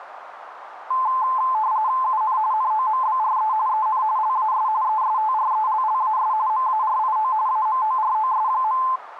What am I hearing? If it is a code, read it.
RTTY (45.45 baud, 170 Hz shift), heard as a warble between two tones, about 950 Hz centre, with radio static and a narrow filter. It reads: UN NOMBRE EN LAS ESTRELLAS MARIO AMOROS.